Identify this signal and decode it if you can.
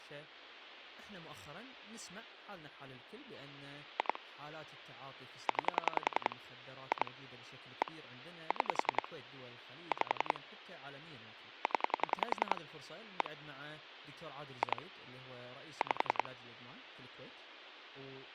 Pulse dialling, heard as clicks on a phone line, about 10 pulses a second, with speech in Arabic. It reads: 2 9 2 1 6 5 0 1 2 5